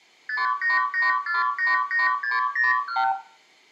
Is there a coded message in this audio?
Yes: multi-frequency trunk signalling (R2, with the far end's replies) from 0.3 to 3.1 s, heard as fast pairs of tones, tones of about 160 ms, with room echo. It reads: 588488601